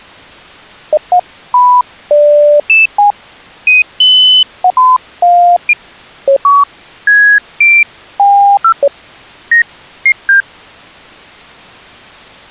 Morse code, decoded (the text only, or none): none